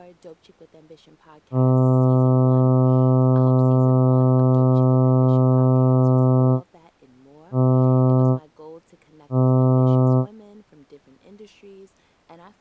Ship horn signal, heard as a ship's horn, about 130 Hz, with speech in English. 1 long, 2 short. At sea: a vessel in fog that is sailing, fishing, towing or hampered.